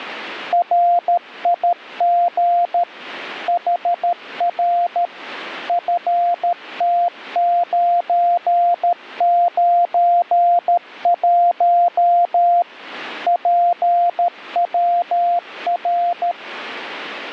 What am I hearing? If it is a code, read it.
Morse code, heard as a keyed tone, machine-sent, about 13 wpm, 700 Hz. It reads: RIG HR FT991 PWR